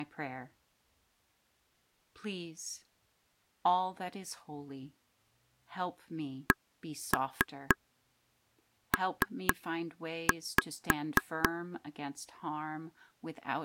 Tap code, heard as taps on a table, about 4 knocks a second, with speech in English. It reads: CP